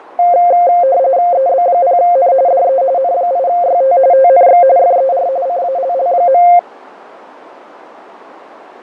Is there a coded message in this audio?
Yes: RTTY (45.45 baud, 170 Hz shift) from 0.2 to 6.6 s, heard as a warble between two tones, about 620 Hz centre, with radio static and fading. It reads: EB0N DE N8YT TNX FER CALL.